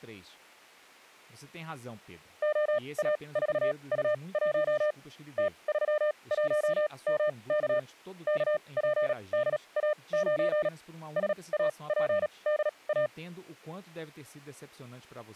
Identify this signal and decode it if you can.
Morse code, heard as a keyed tone, machine-sent, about 37 wpm, spaced as for 26 wpm, 600 Hz, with speech in Portuguese. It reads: OA4U1 T31MK KPDA9 SAPDA